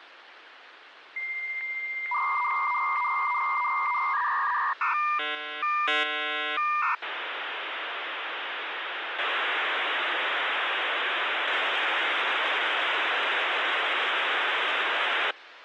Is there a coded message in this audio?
Yes: dial-up modem handshake (V.34 or later) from 1.2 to 15.3 s, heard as a whistle, warbles, then hiss, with phone line noise.